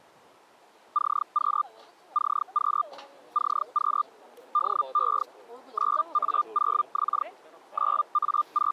Hellschreiber (Feld-Hell, 122.5 baud), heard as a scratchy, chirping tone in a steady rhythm, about 1200 Hz, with the noise of a residential street. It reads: CQ CQ CQ DE 9A0X …